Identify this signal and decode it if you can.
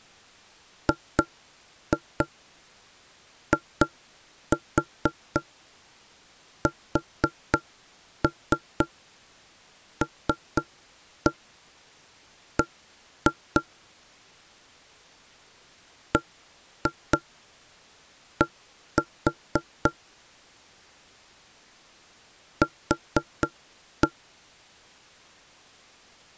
Tap code, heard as knocks on wood, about 4 knocks a second. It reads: GISLB BD Q